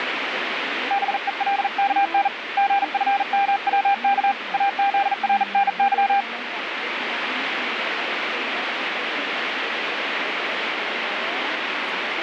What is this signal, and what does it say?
Morse code, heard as a keyed tone, hand-sent with a bug key, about 40 wpm, 800 Hz, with radio static. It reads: BELKN GFMWK AZRNY